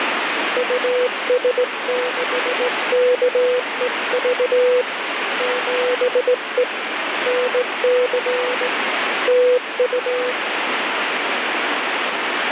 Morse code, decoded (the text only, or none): US6KEV 7E NC TU